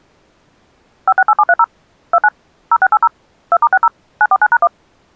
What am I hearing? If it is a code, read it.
DTMF, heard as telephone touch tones, dialled by machine, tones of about 50 ms. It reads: 568730 29 0680 2*60 949#1